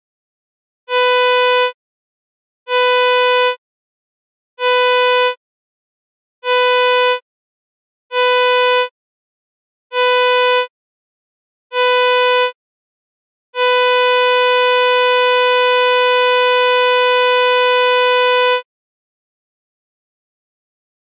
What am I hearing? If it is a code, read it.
Ship horn signal, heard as a ship's horn, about 500 Hz. 7 short, 1 long. At sea: general emergency alarm.